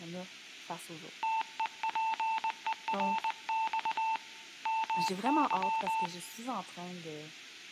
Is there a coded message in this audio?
Yes: Morse code (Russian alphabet) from 1.2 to 6.1 s, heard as a keyed tone, hand-sent with a paddle, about 20 wpm, 890 Hz, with speech in French. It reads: ТЕПЕРЬ МЫ